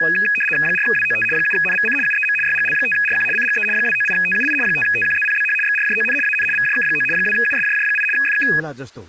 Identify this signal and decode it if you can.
RTTY (75 baud, 850 Hz shift), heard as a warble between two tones, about 2100 Hz centre, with speech in Nepali. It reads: 4WOT 7NVC UEM YGL5RQ CGE 298TUI 5TQZPBH XRJON AN VJK9 2USJJ8 FK